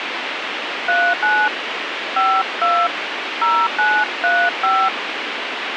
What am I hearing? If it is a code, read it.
DTMF, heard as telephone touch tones, dialled by hand, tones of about 250 ms, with radio hiss. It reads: 39 52 0935